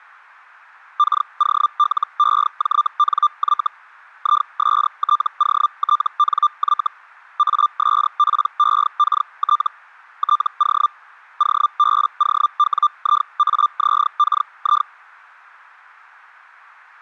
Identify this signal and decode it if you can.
Hellschreiber (Feld-Hell, 122.5 baud), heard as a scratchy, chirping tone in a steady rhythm, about 1190 Hz. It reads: KOLEJNY ISTOTNY ASPEKT TO OBOWIAZKI